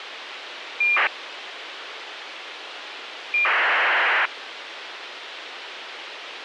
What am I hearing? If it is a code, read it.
ACARS aircraft data, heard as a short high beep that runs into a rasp, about 2400 baud, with radio hiss.